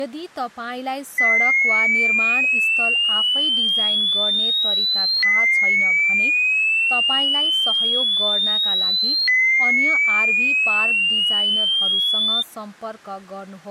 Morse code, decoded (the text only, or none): none